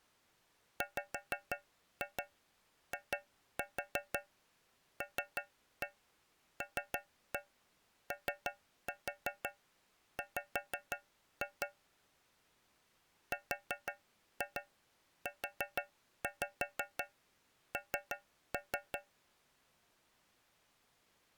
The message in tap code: WILLOW RUN

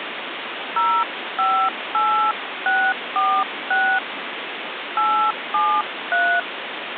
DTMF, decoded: 058646 873

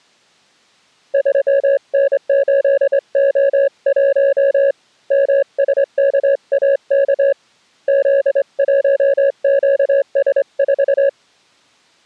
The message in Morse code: 3N8O1 MSKAK Z1QS4

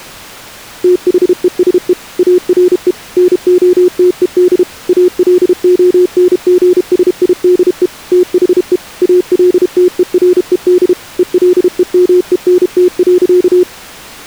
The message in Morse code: THESE ARE NOTED ALONGSIDE THE ALTERED ELEMENT.

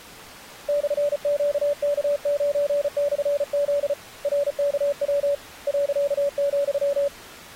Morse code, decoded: /QK9/Z RKW .,

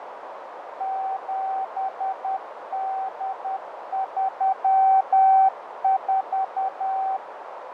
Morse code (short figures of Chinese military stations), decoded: 7834

